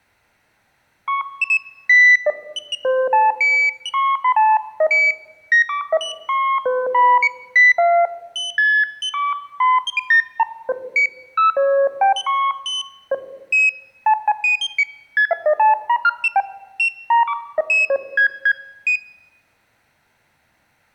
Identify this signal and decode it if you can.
Electronic bleeps of random pitch and length. There is no code.